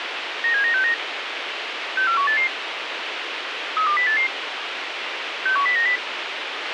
Five-tone selective call (CCIR), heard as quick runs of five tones, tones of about 100 ms, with radio hiss and a squelch burst at the end. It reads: 97969 64188 32088 61090